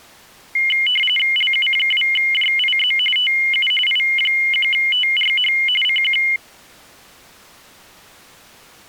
RTTY (45.45 baud, 850 Hz shift), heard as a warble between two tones, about 2550 Hz centre. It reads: LU2JIZ TU I1TRH CQ